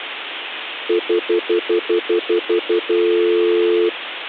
Telephone call progress tone (North American plan), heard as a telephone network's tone, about 350, 440 Hz, 0.1 s on and 0.1 s off. Stutter dial tone.